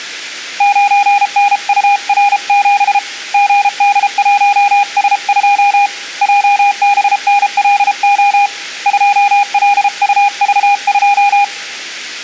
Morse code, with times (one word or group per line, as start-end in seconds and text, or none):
0.6-3.0 9NUR7
3.3-5.9 GD1S2
6.2-8.5 JBNLO
8.9-11.4 2LUV2